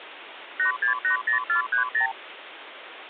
Multi-frequency trunk signalling (R2, with the far end's replies), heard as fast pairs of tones, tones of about 110 ms, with phone line noise. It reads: 8680430